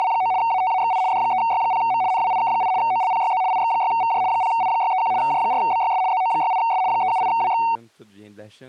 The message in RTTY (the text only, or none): … ATAXI D3Y0M NWIK8 OLPYZ IX6VJ 0I631 J4BYS ZO68S 378WX